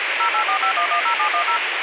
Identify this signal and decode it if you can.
DTMF, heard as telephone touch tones, dialled by machine, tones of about 90 ms, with radio hiss and a squelch burst at the end. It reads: 0845110710